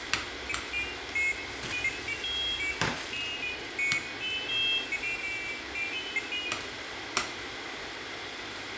Pairs of high tones at irregular times, with radio hiss, room echo and kitchen noise. There is no code.